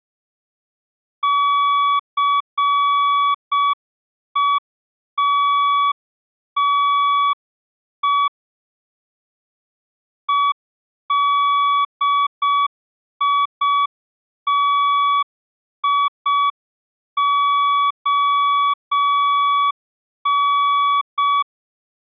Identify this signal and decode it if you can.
Morse code, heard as a keyed tone, hand-sent with a straight key, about 6 wpm, 1140 Hz. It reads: CETTE EDITION